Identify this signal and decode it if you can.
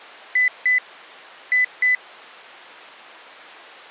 Beep code, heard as a piezo beeper, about 2000 Hz. 2-2.